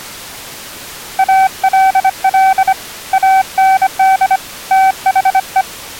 Morse code, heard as a keyed tone, hand-sent with a bug key, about 25 wpm, 770 Hz. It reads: ALL AND THE